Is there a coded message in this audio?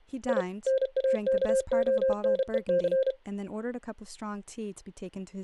Yes: Morse code (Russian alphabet) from 0.2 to 3.2 s, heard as a keyed tone, machine-sent, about 32 wpm, 530 Hz, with speech in English. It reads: И НАКОНЕЦ